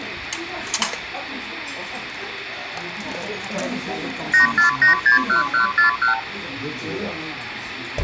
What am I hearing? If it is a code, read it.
Multi-frequency trunk signalling (R2, with the far end's replies), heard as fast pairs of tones, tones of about 120 ms, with phone line noise and the noise of a crowd indoors. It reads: 84861141